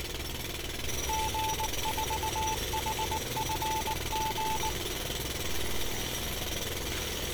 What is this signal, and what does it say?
Morse code, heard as a keyed tone, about 19 wpm, 880 Hz, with street noise. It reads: G4HFG